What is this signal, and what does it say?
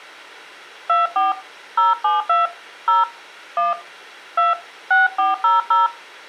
DTMF, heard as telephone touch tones, dialled by hand, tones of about 160 ms, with room echo. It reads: 24 072 0 1 2 6400